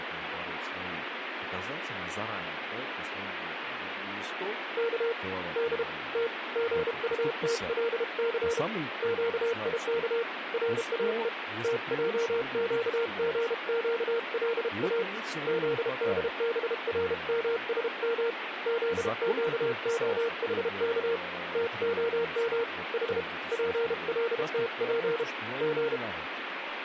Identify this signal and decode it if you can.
Morse code (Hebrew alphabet), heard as a keyed tone, hand-sent with a paddle, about 32 wpm, 460 Hz, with radio static and speech in Russian. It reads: כ ד ת גטתלס קיך ראו תעקגקלא זדברמשם זקהחך תהם ח פלתף ג